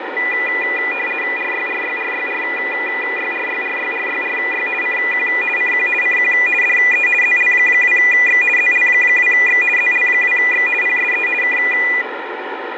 RTTY (50 baud, 450 Hz shift), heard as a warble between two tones, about 2200 Hz centre, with radio static and fading. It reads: RYRYRYRYRYRYRYRY CQ CQ CQ DE ZL2X ZL2X ZL2X PSE K